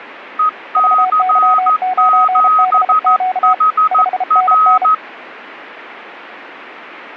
Morse code, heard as two keyed tones. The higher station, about 14 wpm, 1260 Hz: EC7HR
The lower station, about 33 wpm, 740 Hz: VY9BQ 5NN